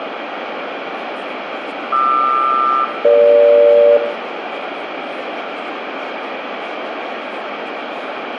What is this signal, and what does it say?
Aircraft SELCAL, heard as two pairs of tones, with radio static, room echo and speech in Maithili. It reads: QR-EG